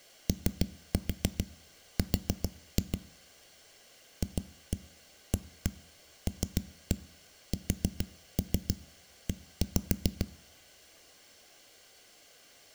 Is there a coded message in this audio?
Yes: tap code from 0.3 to 10.3 s, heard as knocks on a wall, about 7 knocks a second. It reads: OR FALSE